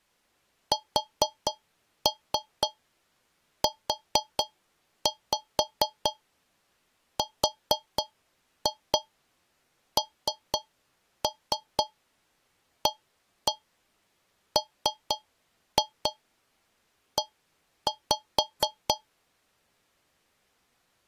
Tap code, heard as taps on a metal pipe, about 4 knocks a second. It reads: SURNAME